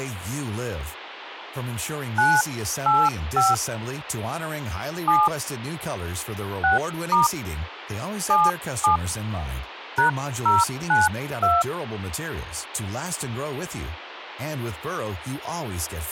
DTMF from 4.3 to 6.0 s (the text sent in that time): 7